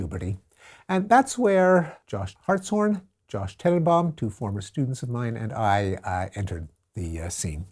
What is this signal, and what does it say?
Speech in English. There is no code.